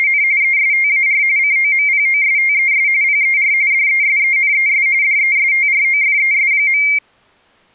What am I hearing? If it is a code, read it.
RTTY (45.45 baud, 170 Hz shift), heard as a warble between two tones, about 2200 Hz centre. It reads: … ESTAR COMPOSTES PER DESENES DESTROFES.